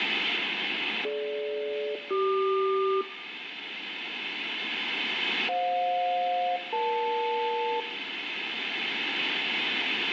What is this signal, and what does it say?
Aircraft SELCAL, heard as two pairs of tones, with radio static. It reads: DG-CQ FJ-EL